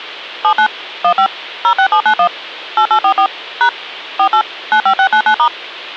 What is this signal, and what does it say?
DTMF, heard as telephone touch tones, dialled by machine, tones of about 80 ms, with hum. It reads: 79 15 06791 8844 # 48 95699*